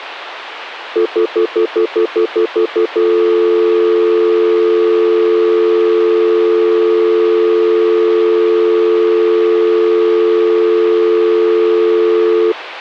Telephone call progress tone (North American plan), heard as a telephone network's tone, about 350, 440 Hz, 0.1 s on and 0.1 s off. Stutter dial tone.